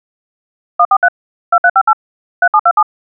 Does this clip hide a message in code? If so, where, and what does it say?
Yes: DTMF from 0.8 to 2.8 s, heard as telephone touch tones, dialled by machine, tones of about 60 ms. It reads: 143 2358 3727